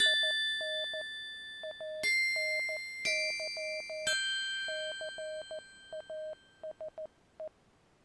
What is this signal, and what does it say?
Morse code, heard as a keyed tone, hand-sent with a paddle, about 14 wpm, 620 Hz. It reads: IN ANY CASE